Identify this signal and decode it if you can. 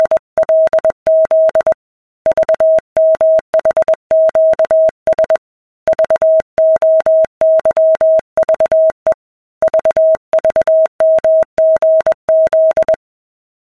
Morse code, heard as a keyed tone, hand-sent with a paddle, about 21 wpm, 640 Hz. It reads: … VMHQS VOYVE VVMGZ